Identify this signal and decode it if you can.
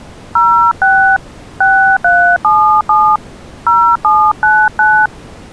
DTMF, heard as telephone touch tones, dialled by hand, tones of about 290 ms. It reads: 06 6377 0799